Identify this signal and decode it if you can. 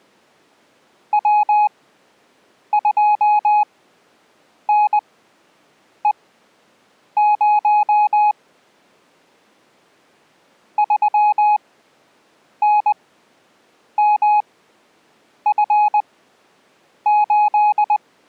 Morse code, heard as a keyed tone, machine-sent, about 20 wpm, spaced as for 7 wpm, 840 Hz. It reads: W2NE0 3NMF8